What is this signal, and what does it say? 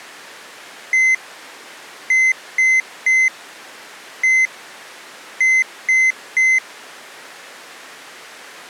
Beep code, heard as a piezo beeper, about 2050 Hz. 1-3-1-3. In Phoenix BIOS tables: keyboard controller test failure.